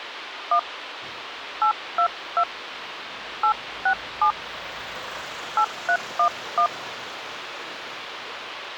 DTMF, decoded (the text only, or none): 1 822 867 8311